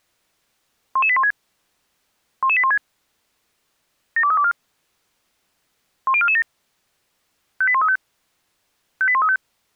Five-tone selective call (ZVEI), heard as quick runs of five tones, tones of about 70 ms. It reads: 11816 11816 72324 10447 58135 58135